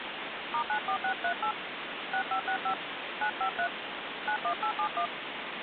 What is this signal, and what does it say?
DTMF, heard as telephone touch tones, dialled by hand, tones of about 90 ms, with phone line noise. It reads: *94638 6565 953 91871